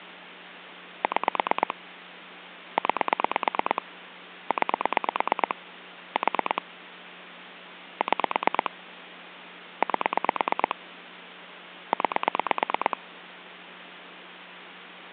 Pulse dialling, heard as clicks on a phone line, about 9 pulses a second, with phone line noise. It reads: 6 9 9 4 6 8 9